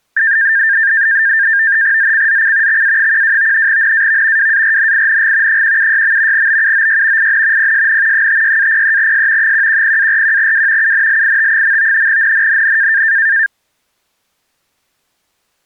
NAVTEX (SITOR-B), 100 baud, 170 Hz shift, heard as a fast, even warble, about 1700 Hz centre. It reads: ZCZC XA12 NAV WARNING 176. BUOY IN PSN 56-03S 110-41W UNLIT. NNNN